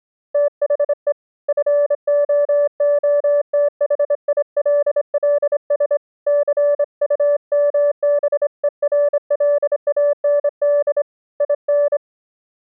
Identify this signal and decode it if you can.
Morse code, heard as a keyed tone, hand-sent with a straight key, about 26 wpm, 580 Hz. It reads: THE FOOTHILLS CUMBERLAND IN